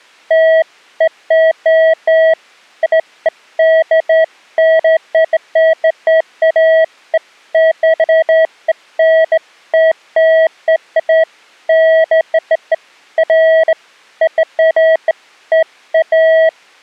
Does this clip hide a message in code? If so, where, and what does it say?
No, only beeps of irregular length.